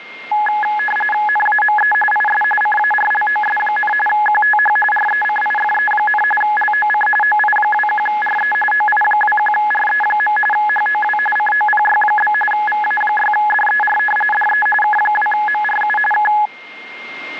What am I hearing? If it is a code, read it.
RTTY (45.45 baud, 850 Hz shift), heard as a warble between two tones, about 1270 Hz centre, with radio static and a steady whistle near 2120 Hz. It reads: NAME IS CARLOS, QTH RECIFE, LOC OI21RE OI21RE. HOW COPY? VA6DER DE K2MRU K